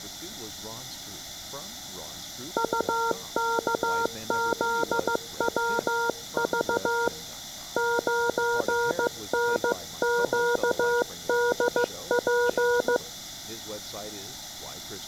Morse code, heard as a keyed tone, hand-sent with a paddle, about 15 wpm, 470 Hz, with room echo and speech in English. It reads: UKZWV 9NQDP